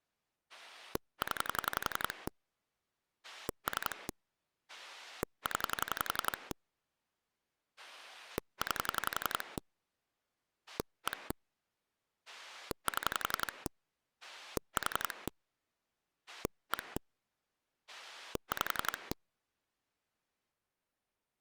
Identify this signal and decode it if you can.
Pulse dialling, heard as a rotary dial, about 11 pulses a second. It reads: 0 3 0 9 1 7 4 1 5